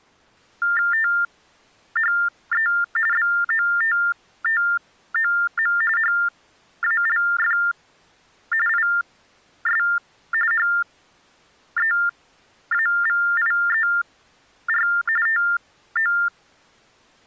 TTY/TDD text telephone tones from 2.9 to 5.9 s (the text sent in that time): BOTTOM